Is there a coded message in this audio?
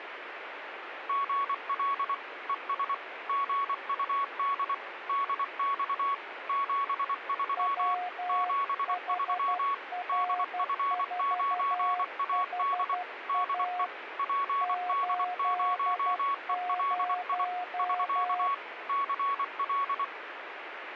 Yes: Morse code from 1.0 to 20.1 s, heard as two keyed tones, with radio static. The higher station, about 24 wpm, 1120 Hz: GL ES GUD DX 73 73 DF9AD DE PD0ELI <SK> CL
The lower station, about 12 wpm, 720 Hz: WHR4HA 80